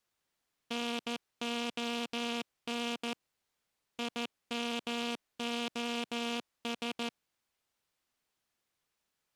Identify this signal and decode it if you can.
Morse code, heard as a buzzer, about 14 wpm. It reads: NON IMOS